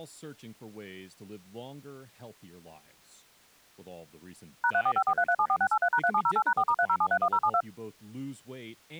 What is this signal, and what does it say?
DTMF, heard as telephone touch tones, dialled by machine, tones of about 70 ms, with speech in English. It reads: #34543374683#3708#4*30731072